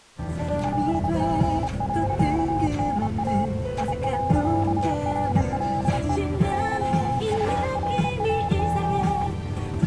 Morse code, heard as a keyed tone, hand-sent with a straight key, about 28 wpm, 820 Hz, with the noise inside a car. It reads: LG.NA I.RLE YURAO